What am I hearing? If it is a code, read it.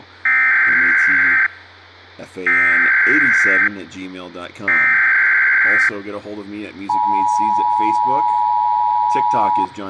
Emergency Alert System (SAME) tones (header bursts, then the 853 and 960 Hz attention tone), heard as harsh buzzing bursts, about 520.83 baud, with speech in English.